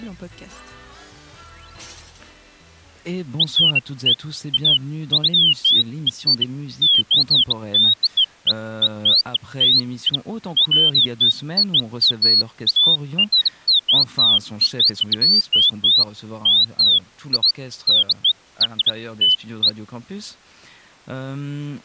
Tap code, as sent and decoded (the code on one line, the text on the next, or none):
none